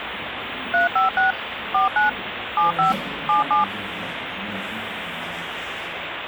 DTMF, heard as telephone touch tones, dialled by machine, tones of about 140 ms, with phone line noise and the noise of a cafe. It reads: 356 49 75 77